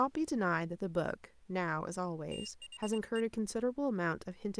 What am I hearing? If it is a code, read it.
Morse code, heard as a high beeper, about 23 wpm, 2800 Hz, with speech in English. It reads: THE